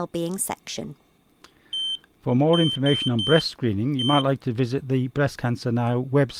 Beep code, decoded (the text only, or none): 1-3-1